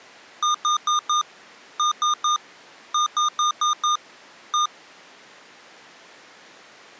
Beep code, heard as beeps from a small speaker, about 1220 Hz. 4-3-5-1.